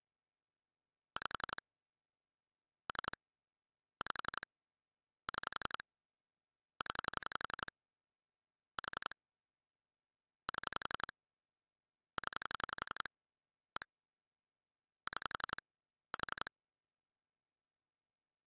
Pulse dialling, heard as clicks on a phone line, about 11 pulses a second. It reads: 5 3 5 6 0 4 7 0 1 6 4